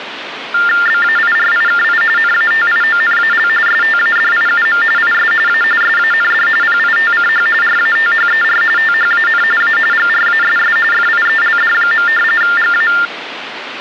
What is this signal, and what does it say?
TTY/TDD text telephone tones (45.45 baud Baudot), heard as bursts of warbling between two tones, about 400 Hz shift, 1600 Hz centre, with phone line noise. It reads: BAIRIKI NATIONAL STADIUM IS A SAND PITCH RATHER THAN A GRASS FIELD. GA